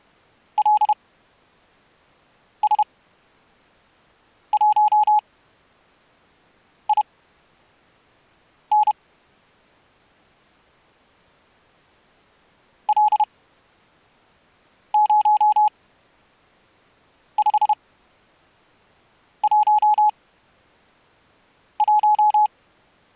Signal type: Morse code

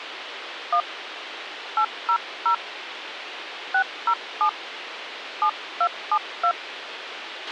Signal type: DTMF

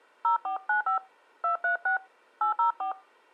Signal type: DTMF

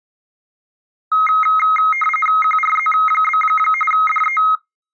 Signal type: RTTY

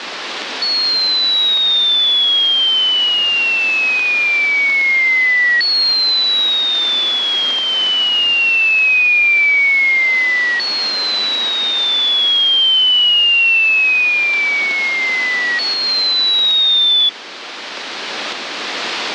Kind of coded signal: none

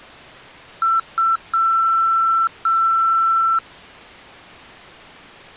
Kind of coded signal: beep code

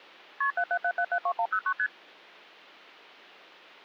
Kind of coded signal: multi-frequency trunk signalling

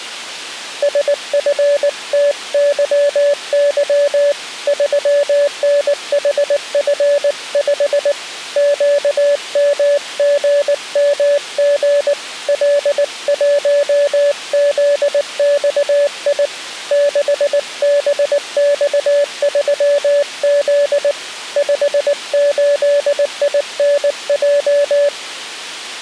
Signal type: Morse code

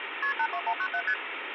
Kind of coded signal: multi-frequency trunk signalling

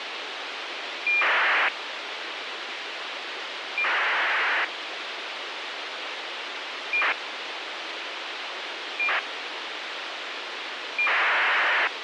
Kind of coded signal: ACARS aircraft data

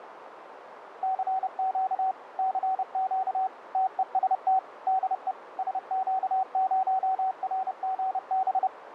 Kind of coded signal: Morse code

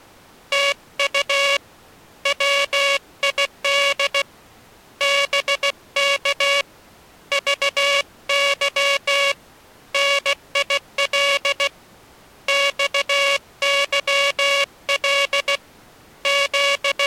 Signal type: Morse code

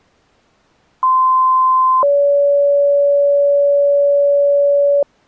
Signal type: two-tone page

